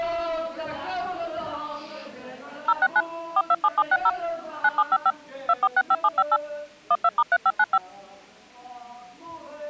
DTMF, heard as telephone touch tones, dialled by machine, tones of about 50 ms. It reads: 069 427760 9755 2465758 12*3595